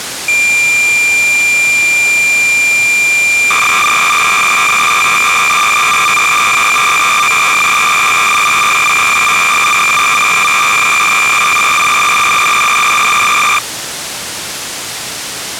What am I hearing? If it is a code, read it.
Cassette data (Kansas City type), 300 baud, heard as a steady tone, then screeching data, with tape hiss.